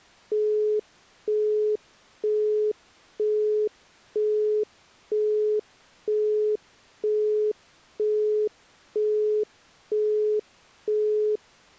Telephone call progress tone (single-tone plan, as in Europe, Japan and elsewhere), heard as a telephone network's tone, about 420 Hz, 0.48 s on and 0.48 s off. Busy tone.